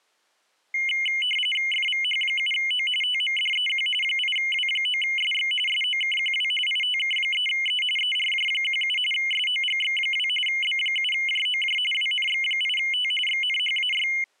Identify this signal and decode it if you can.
RTTY (45.45 baud, 850 Hz shift), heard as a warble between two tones, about 2550 Hz centre. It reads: FVH7O TMDEQ 8W9SX SOKQW ITK3E ERJ17 SOGX2 B7JOJ WNX8T XNHAY